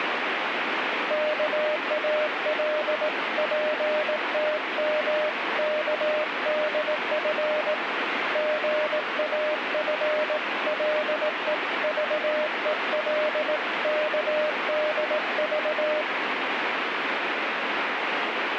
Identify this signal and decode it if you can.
Morse code (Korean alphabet), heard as a keyed tone, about 18 wpm, 610 Hz, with radio static. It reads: 옥점은 손가락을